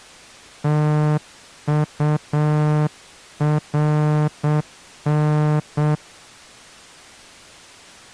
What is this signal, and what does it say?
Morse code, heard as a horn, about 7 wpm. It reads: TURN